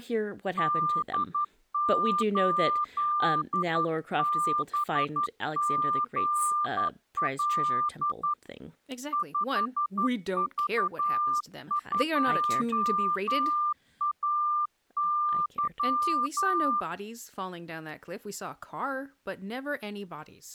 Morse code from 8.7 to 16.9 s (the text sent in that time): 5V2AY